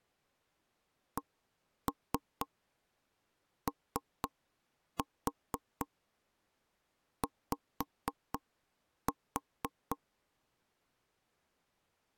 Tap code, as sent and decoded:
1-3 3-4 5-4
COY

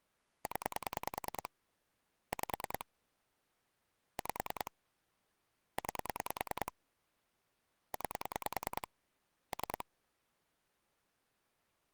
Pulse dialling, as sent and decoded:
10 / 5 / 5 / 9 / 9 / 3
0 5 5 9 9 3

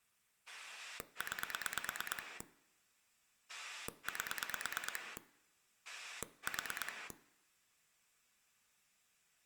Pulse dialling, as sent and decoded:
9 / 8 / 4
9 8 4

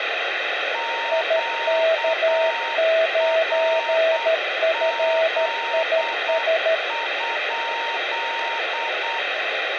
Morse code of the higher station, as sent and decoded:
--.- .-. --.. ..--..
QRZ?

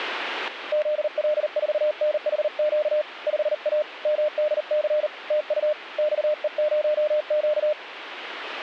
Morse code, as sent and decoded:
--.. .-.. ....- -. .... --.- / ..... .- / -- -.. -.-. / - ..- / -..- . ----- --.-
ZL4NHQ 5A MDC TU XE0Q

